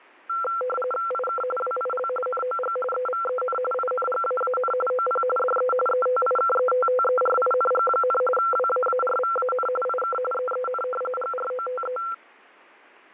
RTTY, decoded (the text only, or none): IK WIL NOG EVEN INGAAN OP DE ETIKETTERING, WAARVAN IK EEN GROTE